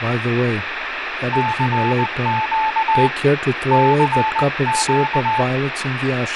Morse code, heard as a keyed tone, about 19 wpm, 870 Hz, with radio static and speech in English. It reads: CQ CQ